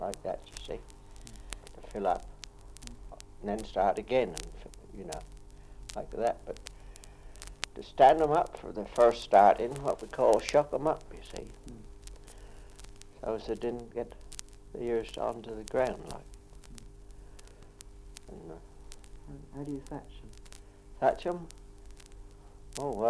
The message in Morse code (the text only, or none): none